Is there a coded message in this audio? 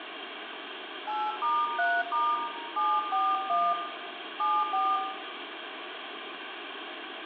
Yes: DTMF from 1.1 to 5.0 s, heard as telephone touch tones, dialled by hand, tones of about 230 ms, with phone line noise and room echo. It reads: 8*3* 741 74